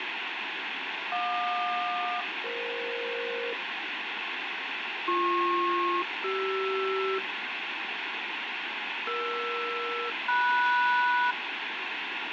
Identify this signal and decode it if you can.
Aircraft SELCAL, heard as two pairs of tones, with radio static. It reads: JQ-EF BP-CR ER-MS